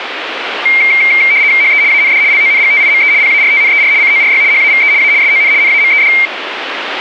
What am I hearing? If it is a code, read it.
RTTY (75 baud, 170 Hz shift), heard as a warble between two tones, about 2200 Hz centre, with radio static. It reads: HE AND LONGTIME PARTNER CORY HAVE A SON NAMED